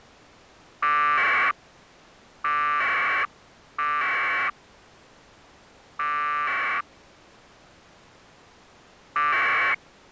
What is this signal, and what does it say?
Packet radio (AX.25, as in APRS), 1200 baud, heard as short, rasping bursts.